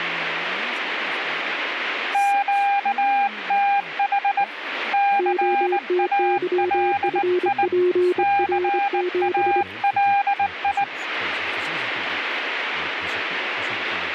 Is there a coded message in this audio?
Yes: Morse code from 2.1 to 10.9 s, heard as two keyed tones, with radio static and speech in Danish. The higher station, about 19 wpm, 800 Hz: QTH CALI CALI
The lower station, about 25 wpm, 360 Hz: OTYFPR7